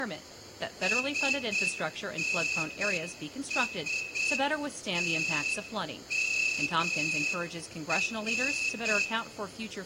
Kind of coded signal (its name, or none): Morse code